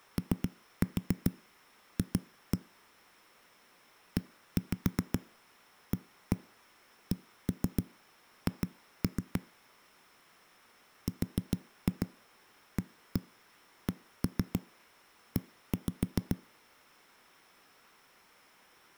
Tap code, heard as knocks on a wall, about 7 knocks a second. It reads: OF EACH RACE